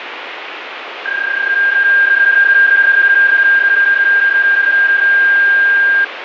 PSK31 (31.25 baud), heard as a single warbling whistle, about 1600 Hz, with radio static and fading.